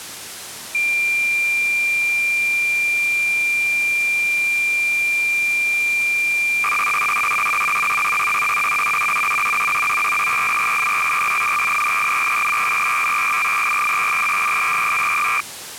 Cassette data (Kansas City type), 300 baud, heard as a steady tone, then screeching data.